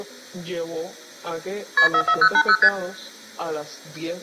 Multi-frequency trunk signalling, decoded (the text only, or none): KP 44080 ST